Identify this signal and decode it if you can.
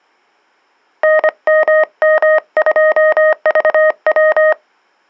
Morse code, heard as a keyed tone, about 25 wpm, 620 Hz. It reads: NMM2VW